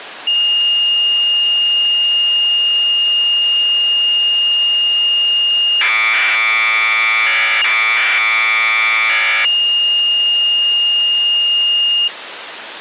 Commodore tape loading (standard loader), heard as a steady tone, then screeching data.